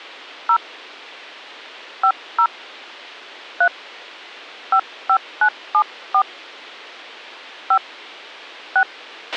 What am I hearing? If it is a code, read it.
DTMF, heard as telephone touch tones, dialled by hand, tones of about 80 ms, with a squelch burst at the end. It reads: 0 50 3 55974 5 6